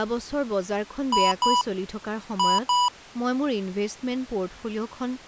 Beep code, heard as beeps from a small speaker, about 980 Hz, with speech in Assamese. 2-2.